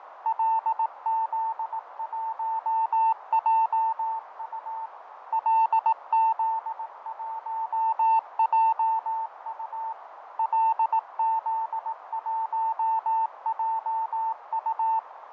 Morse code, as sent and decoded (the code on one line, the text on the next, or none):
.-.. --.. .---- .--- ..- / .-.. --.. .---- .--- ..- / .-.. --.. .---- .--- ..-
LZ1JU LZ1JU LZ1JU